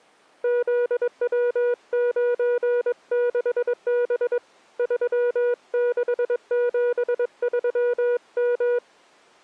Morse code, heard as a keyed tone, hand-sent with a paddle, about 22 wpm, 480 Hz. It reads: ZW96B 3673M